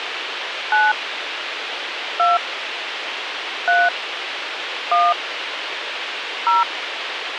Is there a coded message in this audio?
Yes: DTMF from 0.7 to 6.6 s, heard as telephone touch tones, dialled by hand, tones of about 170 ms, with radio hiss. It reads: 9 2 3 1 0